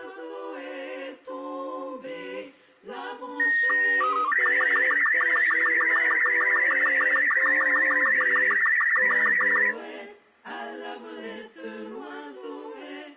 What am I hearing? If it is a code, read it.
SSTV (slow-scan television), Robot 36, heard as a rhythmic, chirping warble.